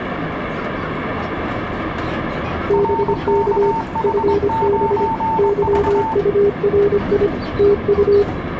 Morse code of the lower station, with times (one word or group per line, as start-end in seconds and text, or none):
2.7-3.7 BK
4.0-5.1 FB
5.4-7.3 YURI
7.6-8.2 TU